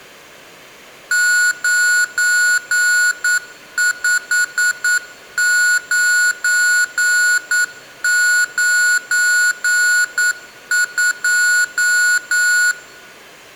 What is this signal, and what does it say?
Morse code, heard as electronic beeps, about 9 wpm, 1460 Hz. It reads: 95992